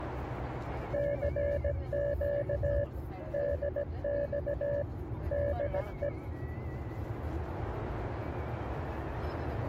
Morse code, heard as a keyed tone, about 17 wpm, 570 Hz, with the noise inside a car. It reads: CQ DX DE